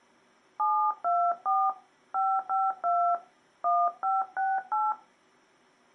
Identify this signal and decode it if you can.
DTMF, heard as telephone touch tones, dialled by hand, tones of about 240 ms. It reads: 724 552 1568